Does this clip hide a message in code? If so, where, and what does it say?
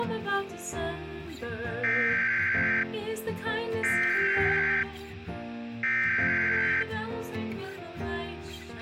Yes: Emergency Alert System (SAME) tones (header bursts) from 1.8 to 6.8 s, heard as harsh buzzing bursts, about 520.83 baud, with a squelch burst at the end.